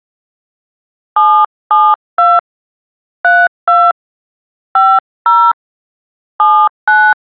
DTMF, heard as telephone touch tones, dialled by hand, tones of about 250 ms. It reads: 772 32 50 79